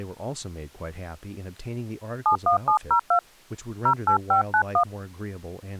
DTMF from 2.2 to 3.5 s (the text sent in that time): 71702